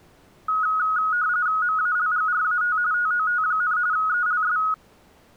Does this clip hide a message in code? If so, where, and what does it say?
Yes: RTTY (45.45 baud, 170 Hz shift) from 0.5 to 4.7 s, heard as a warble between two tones, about 1360 Hz centre. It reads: MALGRAT TOT, ELS